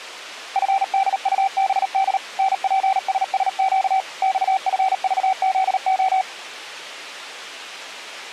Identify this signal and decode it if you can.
Morse code, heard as a keyed tone, machine-sent, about 38 wpm, 770 Hz. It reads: FDUBD NPSSQ XFVZO